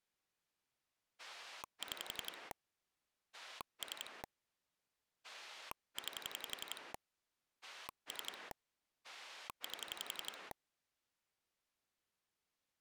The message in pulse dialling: 6 3 9 3 8

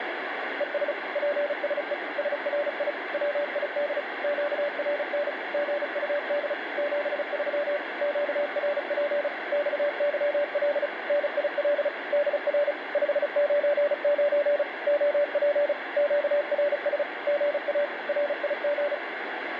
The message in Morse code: ES PSE SRI WID QRN GUD 73 QRP XYL NIL DR 599 OP QRS GA RIG

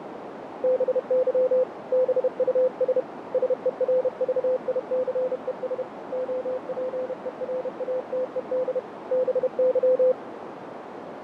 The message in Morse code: BY BUS SERVICES OPERATED BY

